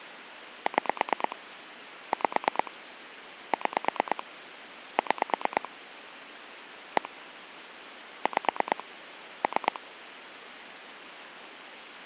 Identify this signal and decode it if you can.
Pulse dialling, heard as clicks on a phone line, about 9 pulses a second, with phone line noise. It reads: 6 5 6 6 1 5 3